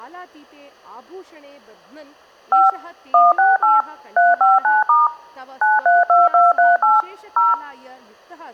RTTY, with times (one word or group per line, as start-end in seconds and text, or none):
none